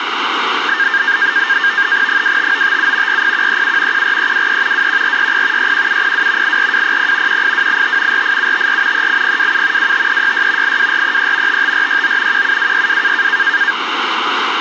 NAVTEX (SITOR-B), 100 baud, 170 Hz shift, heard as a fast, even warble, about 1700 Hz centre, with radio static. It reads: 25957 40137 14323 21460 61702 84200 18285 48754 38027 25366 82433 55469 17262